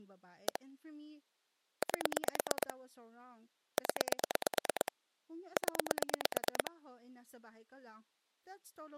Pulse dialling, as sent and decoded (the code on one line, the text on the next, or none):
1 / 8 / 10 / 10
1 8 0 0